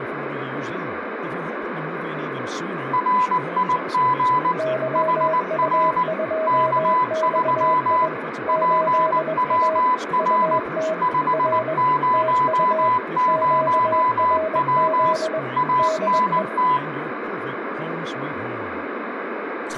Morse code, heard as two keyed tones, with radio static, room echo and speech in English. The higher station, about 19 wpm, 1000 Hz: RIG HR K3 PWR 500W ANT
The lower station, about 21 wpm, 640 Hz: YU2XI 8A UT R TU QRZ DE